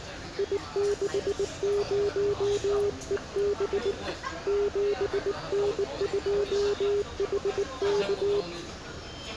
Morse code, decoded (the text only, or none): I60EB 7N2HK